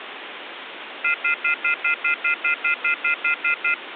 Telephone call progress tone (North American plan), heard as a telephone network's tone, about 1400, 2050, 2450, 2600 Hz, 0.1 s on and 0.1 s off, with phone line noise. Off-hook warning tone.